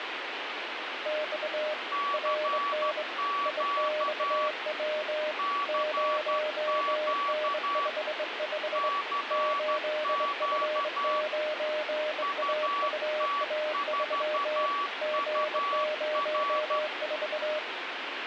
Morse code, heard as two keyed tones, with radio static. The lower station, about 23 wpm, 610 Hz: X RN IXW 0N55 8F9AUA3 G04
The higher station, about 12 wpm, 1140 Hz: CQ CQ CQ UT4UR